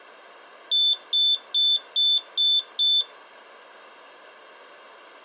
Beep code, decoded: 6 short

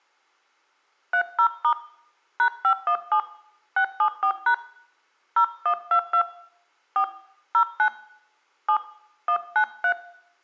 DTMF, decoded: 30* #517 674# 0122 4 09 7 193

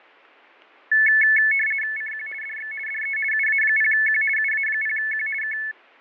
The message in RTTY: CQ DX DE UA0Q UA0Q K

